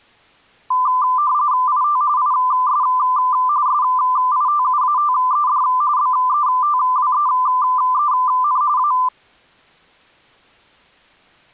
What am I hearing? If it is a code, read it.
RTTY (45.45 baud, 170 Hz shift), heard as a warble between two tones, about 1100 Hz centre. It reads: IT IS SITUATED BETWEEN A